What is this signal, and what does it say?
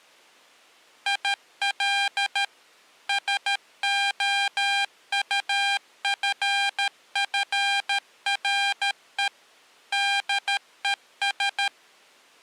Morse code, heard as electronic beeps, machine-sent, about 13 wpm, 800 Hz. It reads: IL SOUFFRE DES